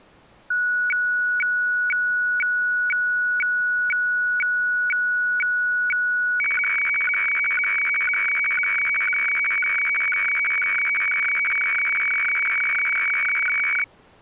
Weather fax (radiofax), 120 lines a minute, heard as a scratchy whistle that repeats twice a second.